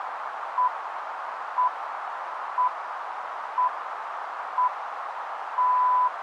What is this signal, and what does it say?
Radio time signal (six pips, as the Greenwich Time Signal), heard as pips, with radio static and a narrow filter.